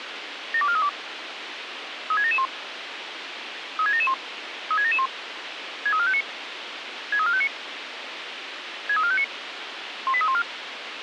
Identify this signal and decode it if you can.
Five-tone selective call (ZVEI), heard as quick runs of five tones, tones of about 70 ms, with radio hiss. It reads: 72432 36771 36771 36771 63459 63459 63459 18314